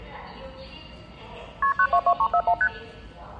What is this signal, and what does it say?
Multi-frequency trunk signalling (R1, as on North American trunks), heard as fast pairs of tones, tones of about 70 ms, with the noise of a subway station. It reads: KP 922341 ST